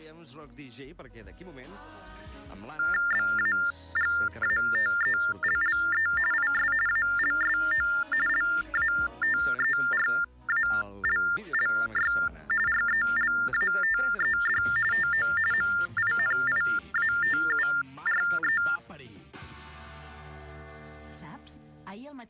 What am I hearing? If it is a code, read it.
TTY/TDD text telephone tones (45.45 baud Baudot), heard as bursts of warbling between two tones, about 400 Hz shift, 1600 Hz centre. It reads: BAGATELLE IS ALSO LATERALLY RELATED TO MINIATURE